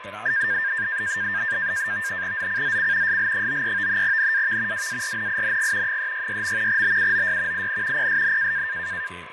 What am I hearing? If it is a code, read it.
NAVTEX (SITOR-B), 100 baud, 170 Hz shift, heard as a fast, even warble, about 1700 Hz centre, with radio static, fading, a steady whistle near 1020 Hz and speech in Italian. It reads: ZCZC SL93 NAV WARNING 366. BUOY IN PSN